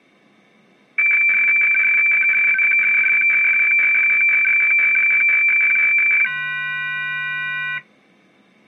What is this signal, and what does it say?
Weather fax (radiofax), 120 lines a minute, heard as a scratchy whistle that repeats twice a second.